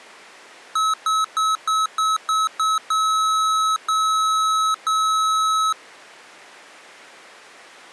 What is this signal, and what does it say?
Beep code, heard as beeps from a small speaker, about 1290 Hz. 7 short, 3 long.